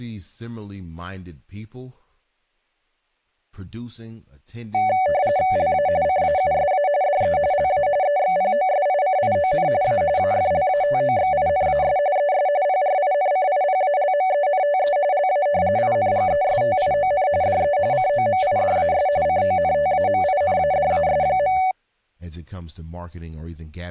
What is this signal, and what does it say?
RTTY (45.45 baud, 170 Hz shift), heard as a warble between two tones, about 670 Hz centre, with speech in English. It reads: LA CAUSA DE LA EXPOSICION A AFLATOXINAS ES PRINCIPALMENTE LA INGESTION DE COMIDAS CONTAMINADAS.